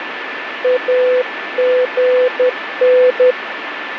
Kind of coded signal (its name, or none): Morse code